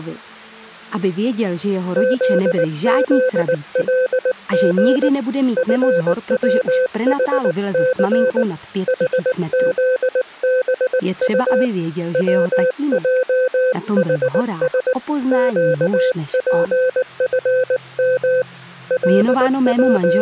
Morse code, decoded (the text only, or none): ZZLG FWHC HZBU WJHS QPFM …